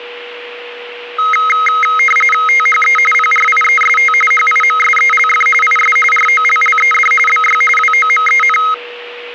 RTTY (45.45 baud, 850 Hz shift), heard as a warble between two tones, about 1700 Hz centre, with a steady whistle near 480 Hz. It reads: THE PRIEST HIMSELF IS ROLLED BY WOMEN